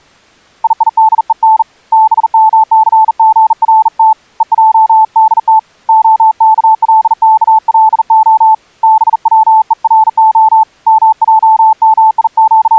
Morse code (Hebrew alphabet), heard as a keyed tone, hand-sent with a bug key, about 40 wpm, 880 Hz. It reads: יידון במסגרת ועדת הכלכלה בצורה …